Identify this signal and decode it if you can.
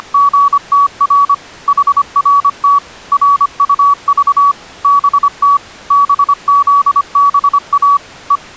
Morse code, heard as a keyed tone, machine-sent, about 25 wpm, 1140 Hz. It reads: … HRT RUV BT BZBA E